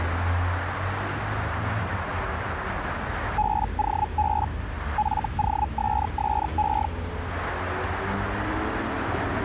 Hellschreiber (Feld-Hell, 122.5 baud), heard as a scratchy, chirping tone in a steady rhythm, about 850 Hz, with street noise. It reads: BOB FOSSE